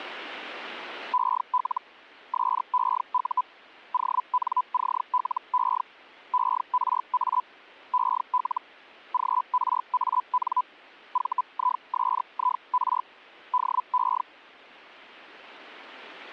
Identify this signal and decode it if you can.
Hellschreiber (Feld-Hell, 122.5 baud), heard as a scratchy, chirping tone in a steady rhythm, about 1000 Hz. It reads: EL SEU ONCLE ERA EL GRAN VISIR DE